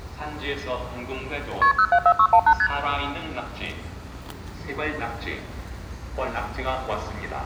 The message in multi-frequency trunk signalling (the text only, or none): KP 074618 ST